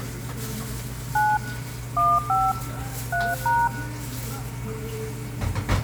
DTMF, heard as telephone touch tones, dialled by machine, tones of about 220 ms, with the noise of a cafe. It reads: 9 15 3#